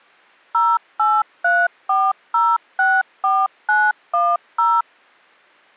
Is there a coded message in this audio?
Yes: DTMF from 0.5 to 4.8 s, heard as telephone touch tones, dialled by machine, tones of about 230 ms. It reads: 0834064910